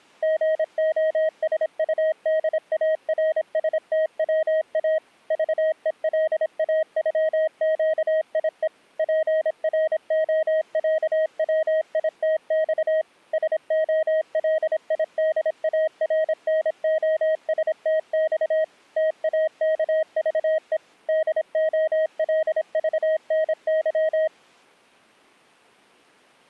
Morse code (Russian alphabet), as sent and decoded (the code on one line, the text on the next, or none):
--. --- ... ..- -.. .- .-. ... - .-- .- / ...- . .-.. .- ..-- --.- .. . / .--. .-. --- .-.- .-- .. - -..- / ... --- .-.. .. -.. .- .-. -. --- ... - -..- / - .- -.- ...- . / -.. --- .-.. ...- -. -.--
ГОСУДАРСТВА ЖЕЛАЮЩИЕ ПРОЯВИТЬ СОЛИДАРНОСТЬ ТАКЖЕ ДОЛЖНЫ